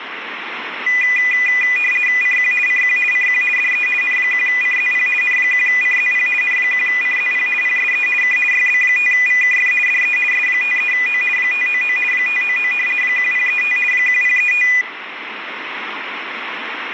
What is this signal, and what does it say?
RTTY (50 baud, 450 Hz shift), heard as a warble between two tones, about 2200 Hz centre, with radio static. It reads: CQ CQ CQ DE N1CZP N1CZP N1CZP PSE K YB5VKF DE S53O 599 599 1035 1035